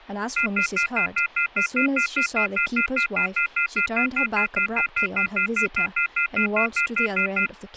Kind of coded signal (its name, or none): telephone call progress tone